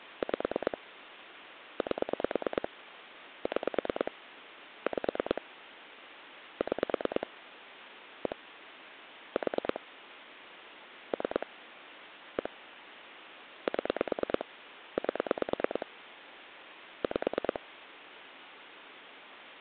Pulse dialling, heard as clicks on a phone line, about 9 pulses a second, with phone line noise. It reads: 5 8 6 5 6 1 4 3 1 7 8 5